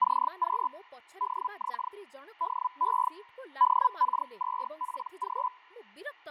Hellschreiber (Feld-Hell, 122.5 baud), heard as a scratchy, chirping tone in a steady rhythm, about 1000 Hz, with fading and speech in Odia. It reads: CQ DX DE DK2PG